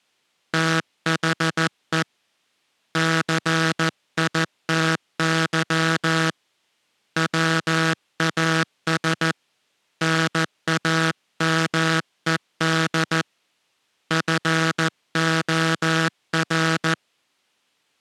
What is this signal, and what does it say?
Morse code, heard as a buzzer, hand-sent with a paddle, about 14 wpm. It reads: THE CITY WAS NAMED FOR